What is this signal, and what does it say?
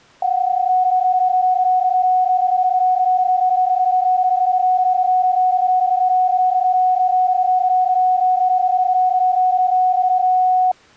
PSK31 (31.25 baud), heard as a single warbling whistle, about 740 Hz.